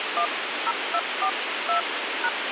DTMF, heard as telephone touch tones, dialled by hand, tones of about 80 ms, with radio hiss. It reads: 10242#